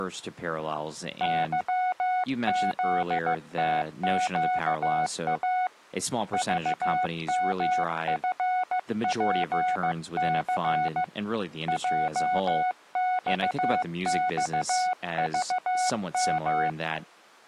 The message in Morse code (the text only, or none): YZTQA VMFPC JXXVM